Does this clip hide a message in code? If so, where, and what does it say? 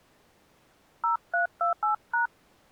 Yes: DTMF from 1.0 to 2.3 s, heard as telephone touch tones, dialled by hand, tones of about 120 ms. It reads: 0328#